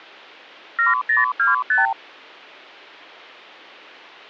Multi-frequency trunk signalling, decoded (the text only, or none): 7025